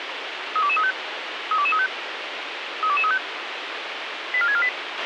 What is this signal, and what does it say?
Five-tone selective call (ZVEI), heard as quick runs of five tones, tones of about 70 ms, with radio hiss and a squelch burst at the end. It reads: 32235 32235 32235 84648